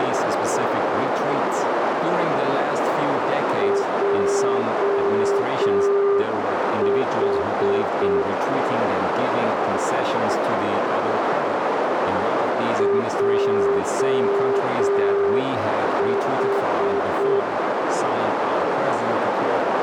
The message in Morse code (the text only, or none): JH JH